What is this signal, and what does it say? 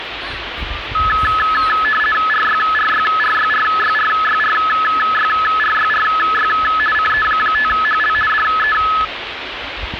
RTTY (50 baud, 450 Hz shift), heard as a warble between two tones, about 1500 Hz centre, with radio static and the noise of a park. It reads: RYRYRYRYRYRYRYRY CE5HL DE